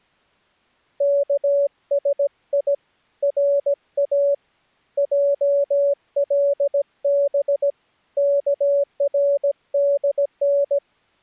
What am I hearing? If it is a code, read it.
Morse code (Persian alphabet), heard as a keyed tone, hand-sent with a paddle, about 17 wpm, 570 Hz. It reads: کسی را جلب کردن